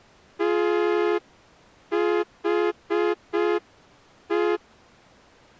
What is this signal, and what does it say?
Morse code, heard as a horn, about 5 wpm. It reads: THE